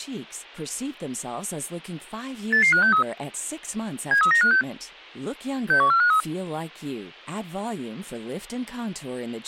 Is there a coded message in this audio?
Yes: five-tone selective call (CCIR) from 2.5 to 6.2 s, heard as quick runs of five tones, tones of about 100 ms, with speech in Spanish. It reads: 88563 73956 61453